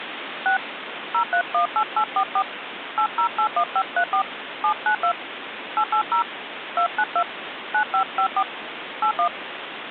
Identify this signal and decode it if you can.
DTMF, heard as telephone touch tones, dialled by hand, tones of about 80 ms, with phone line noise. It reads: 6 0318844 8081534 792 880 292 9554 81